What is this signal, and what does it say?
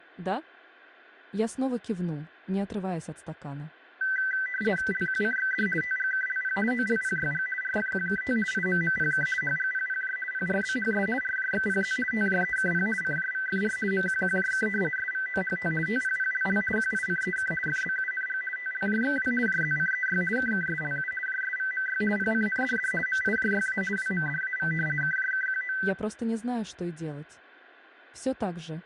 RTTY (50 baud, 450 Hz shift), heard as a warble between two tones, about 1750 Hz centre, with radio static. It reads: LQCXD TGKLP OLPYG RFQKT IMMPK HGPPJ PRBHS RJXPZ TJEKP CJVFR MQQJK SVOHT TPPLL QICEK FBUNG TLJXW JZCEY KKSLU JSVMY PCNDD MIJYA WMDAV KJKQO